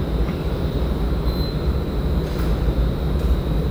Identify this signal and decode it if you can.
The noise of a subway station. There is no code.